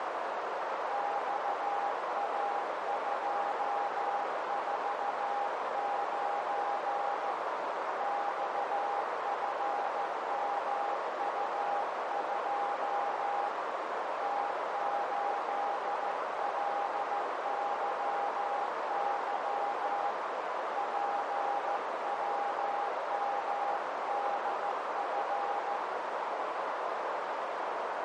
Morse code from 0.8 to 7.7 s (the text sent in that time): XA249